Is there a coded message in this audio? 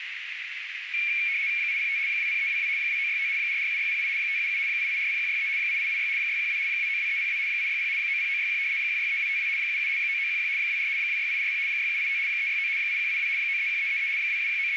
Yes: RTTY (75 baud, 170 Hz shift) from 0.9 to 14.8 s, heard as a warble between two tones, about 2300 Hz centre, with radio static and a narrow filter. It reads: 805 20322 2965 447608 577 8840163 8886 612 292302 860 90961 163252 77 9911 24 26840 6785 369 8182 931333 …